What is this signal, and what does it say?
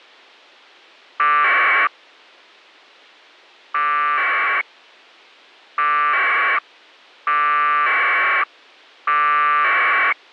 Packet radio (AX.25, as in APRS), 1200 baud, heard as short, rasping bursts.